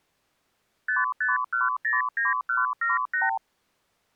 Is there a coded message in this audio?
Yes: multi-frequency trunk signalling (R2, with the far end's replies) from 0.9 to 3.4 s, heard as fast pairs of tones, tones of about 160 ms. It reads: 55109178